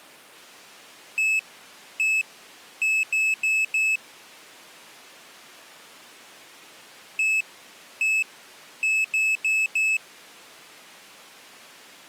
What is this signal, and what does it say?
Beep code, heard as a piezo beeper, played twice, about 2600 Hz. 1-1-4. In Phoenix BIOS tables: BIOS ROM checksum failure.